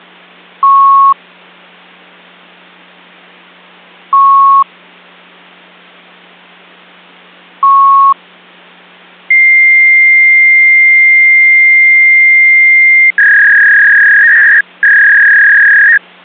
Fax machine handshake, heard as beeps, a long tone and a warble.